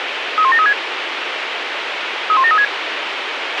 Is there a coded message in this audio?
Yes: five-tone selective call (ZVEI) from 0.4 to 2.6 s, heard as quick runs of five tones, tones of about 70 ms, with radio hiss and a squelch burst at the end. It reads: 31736 31736